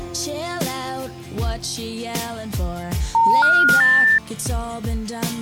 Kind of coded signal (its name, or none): telephone call progress tone